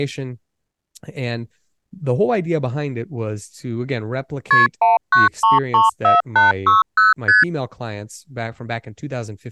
Multi-frequency trunk signalling (R1, as on North American trunks), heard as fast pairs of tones, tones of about 160 ms, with speech in English. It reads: KP 19334860 ST